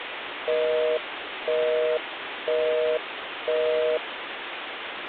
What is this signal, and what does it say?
Telephone call progress tone (North American plan), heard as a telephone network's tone, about 480, 620 Hz, 0.5 s on and 0.5 s off, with phone line noise. Busy tone.